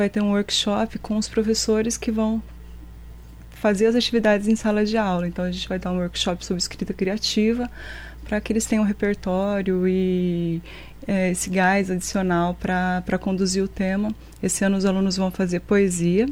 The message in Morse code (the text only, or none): none